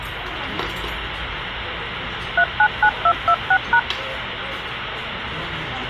DTMF, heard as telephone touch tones, dialled by machine, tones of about 70 ms, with phone line noise and the noise of a restaurant. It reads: 399226#